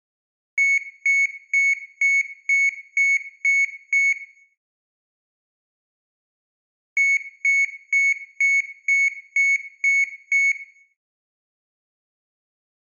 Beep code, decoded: 8 short

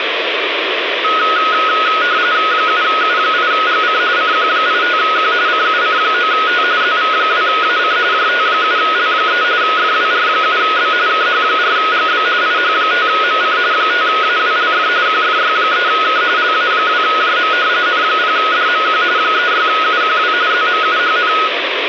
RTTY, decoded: 7U8GC CQ85Q CUC9T ZV2AC JT7L3 FWR7B KH4GB IH5MC 5AWLF QFY3K LA2JM N0DMQ 36UQW ZMUHN

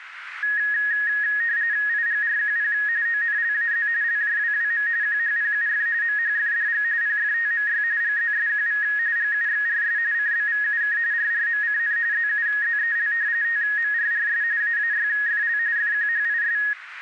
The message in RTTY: IGRQP ONLAZ LJWWM QHPUF MHFDG PFTMY GZSQV GUXRS CBVUK RRMCN ZUZEL TMRRS AAYFL FQHIS

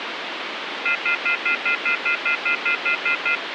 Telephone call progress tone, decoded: off-hook warning tone

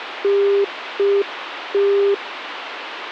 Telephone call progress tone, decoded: congestion tone

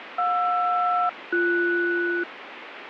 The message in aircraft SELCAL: JR-BS

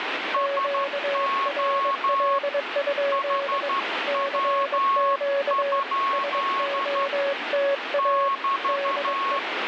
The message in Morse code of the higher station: SO HW? <BT>

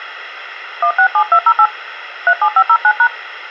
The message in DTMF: 167208 37509#

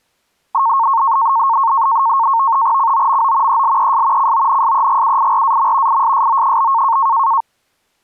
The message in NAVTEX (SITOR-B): COMO ELES CONSEGUIRAM ISSO?

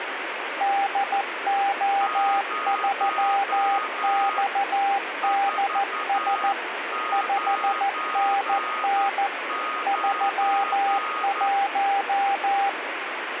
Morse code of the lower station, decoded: DO3XDS 5NN 31

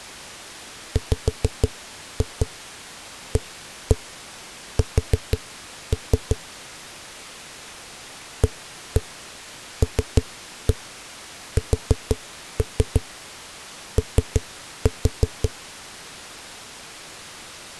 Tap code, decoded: WAS ALSO

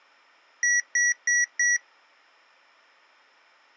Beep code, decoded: 4 short

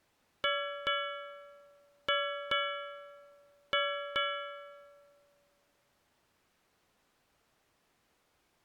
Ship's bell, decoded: 6

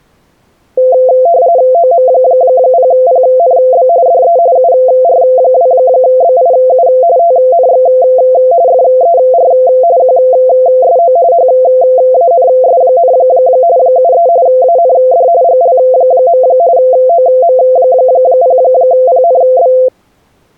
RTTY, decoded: OM0PNB DE UR2BIU TNX FER QSO HANS, 73 AND GL. OM0PNB

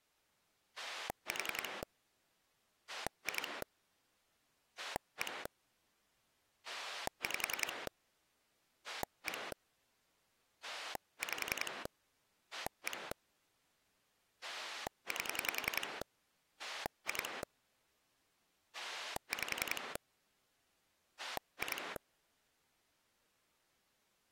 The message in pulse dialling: 4 2 1 5 1 5 1 8 2 5 2

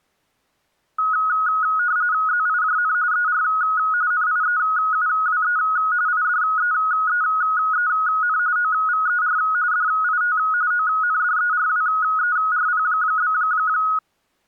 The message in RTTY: ZIJN ER NIEUWE IDEEEN OVER DIT ONDERWERP?

